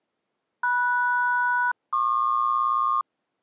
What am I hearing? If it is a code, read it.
Aircraft SELCAL, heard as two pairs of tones. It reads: MS-PQ